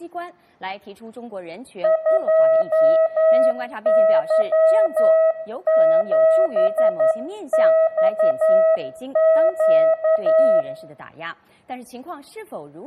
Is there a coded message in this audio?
Yes: Morse code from 1.8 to 10.7 s, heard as a keyed tone, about 11 wpm, 640 Hz, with room echo. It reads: 2Y7XQ